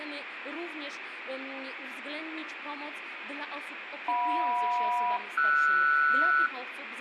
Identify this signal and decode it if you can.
Aircraft SELCAL, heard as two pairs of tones, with radio static and room echo. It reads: JM-RS